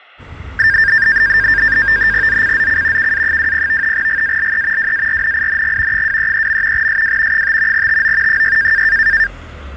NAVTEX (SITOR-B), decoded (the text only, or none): ZCZC KA20 GALE WARNING 233. SW 5 TO 6